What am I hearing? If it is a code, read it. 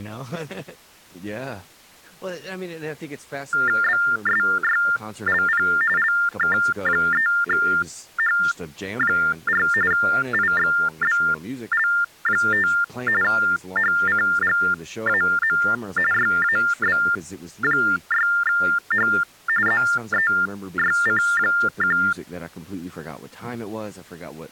TTY/TDD text telephone tones (45.45 baud Baudot), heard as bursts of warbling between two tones, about 400 Hz shift, 1600 Hz centre, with speech in English. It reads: BSYLP LK3H4 IXBL5 HCGAM YAB6H ZEYC1